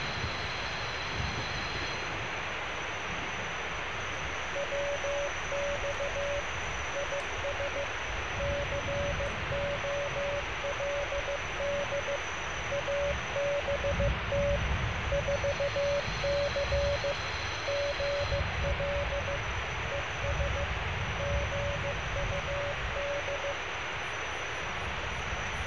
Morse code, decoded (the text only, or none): WX IS COLD ABT 4C GL ES GUD